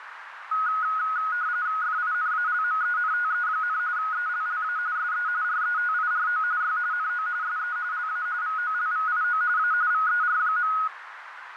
RTTY (45.45 baud, 170 Hz shift), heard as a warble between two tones, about 1360 Hz centre, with radio static and a narrow filter. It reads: FINALMENTE, ELLA SE RETIRO Y NO SE LA VOLVIO A VER.